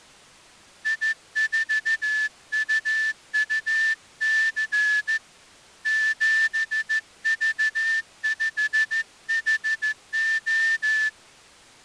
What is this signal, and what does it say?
Morse code, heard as a whistle, hand-sent with a straight key, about 14 wpm. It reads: I4UUC 7V5HO